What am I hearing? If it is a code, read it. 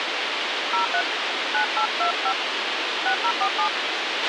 DTMF, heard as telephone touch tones, dialled by hand, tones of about 90 ms, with radio hiss and a squelch burst at the end. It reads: 03 9825 6047